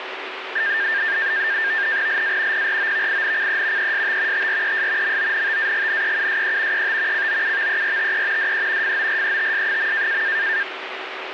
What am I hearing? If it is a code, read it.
NAVTEX (SITOR-B), 100 baud, 170 Hz shift, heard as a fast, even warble, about 1700 Hz centre, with radio static. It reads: LA PROVINCE EST TRES MONTAGNEUSE ET COUVERTE DE FORETS.